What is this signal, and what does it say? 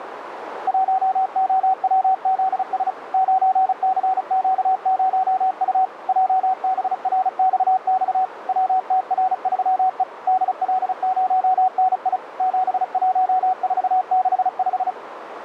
Morse code, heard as a keyed tone, machine-sent, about 35 wpm, 750 Hz, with radio static and a narrow filter. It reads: 1OWZS 9CQ0U JBRXX WTR3E DL0NI 71465